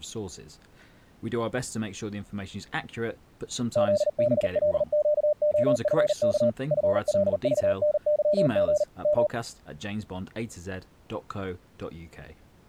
Morse code, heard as a keyed tone, machine-sent, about 39 wpm, 600 Hz, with speech in English. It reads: ZBLQOFK FLVNYG M